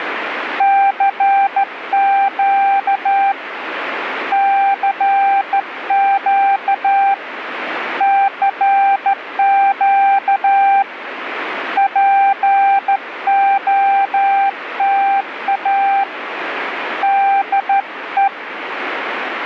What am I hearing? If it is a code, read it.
Morse code, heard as a keyed tone, hand-sent with a straight key, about 13 wpm, 790 Hz, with radio static. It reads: CQ CQ CQ POTA DE